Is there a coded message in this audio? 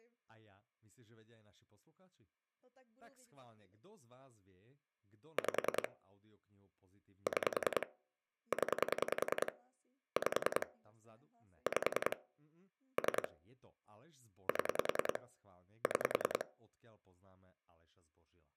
Yes: pulse dialling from 5.4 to 16.4 s, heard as clicks on a phone line, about 10 pulses a second, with speech in Slovak. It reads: 5 6 0 5 5 3 7 6